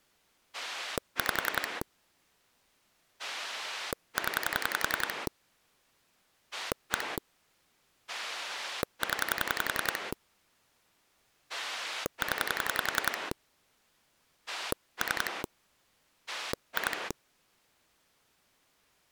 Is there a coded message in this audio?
Yes: pulse dialling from 0.5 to 17.1 s, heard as a rotary dial, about 10 pulses a second. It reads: 5 0 1 0 0 3 2